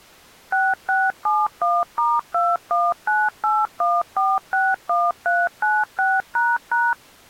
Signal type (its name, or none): DTMF